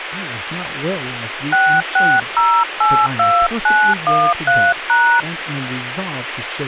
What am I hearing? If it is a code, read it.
DTMF, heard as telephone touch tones, dialled by hand, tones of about 280 ms, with phone line noise and speech in English. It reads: 66082913#